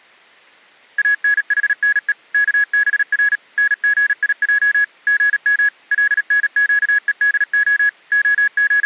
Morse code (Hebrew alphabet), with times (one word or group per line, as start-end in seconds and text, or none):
1.0-2.1 אנחנו
2.3-3.4 כבר
3.6-4.8 נגיע
5.1-5.7 גם
5.9-7.9 לנקודה
8.1-8.9 …